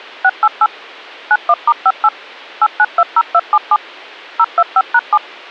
DTMF, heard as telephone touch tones, dialled by machine, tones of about 50 ms. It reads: 688 91*58 8920277 025#7